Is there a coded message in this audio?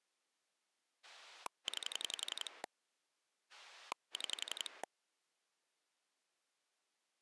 Yes: pulse dialling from 1.0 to 4.8 s, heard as a rotary dial, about 11 pulses a second. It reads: 9 6